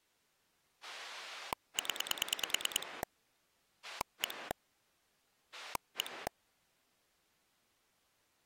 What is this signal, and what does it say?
Pulse dialling, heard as a rotary dial, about 9 pulses a second. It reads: 0 1 1